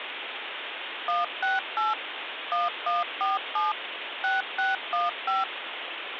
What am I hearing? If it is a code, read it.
DTMF, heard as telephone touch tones, dialled by machine, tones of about 170 ms, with phone line noise. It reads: 168 1147 6615